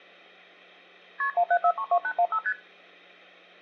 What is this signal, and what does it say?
Multi-frequency trunk signalling (R1, as on North American trunks), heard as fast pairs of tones, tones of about 70 ms. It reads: KP 17432815 ST